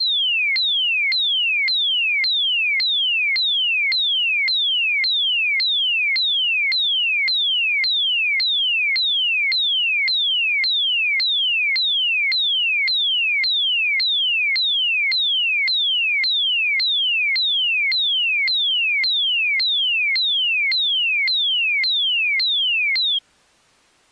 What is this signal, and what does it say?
A tone that sweeps in pitch again and again. There is no code.